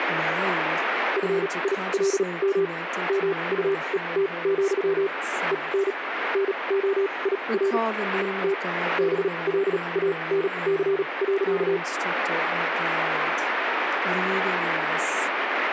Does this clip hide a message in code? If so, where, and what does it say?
Yes: Morse code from 1.1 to 11.8 s, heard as a keyed tone, machine-sent, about 37 wpm, spaced as for 27 wpm, 390 Hz, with radio static and speech in English. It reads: FILM MUET, EN NOIR ET BLANC.